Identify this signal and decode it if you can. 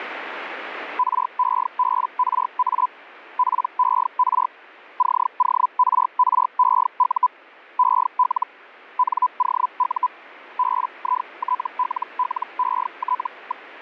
Hellschreiber (Feld-Hell, 122.5 baud), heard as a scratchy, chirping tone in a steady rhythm, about 1000 Hz. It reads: REBRA PER CORREU EL NOU BITLLET.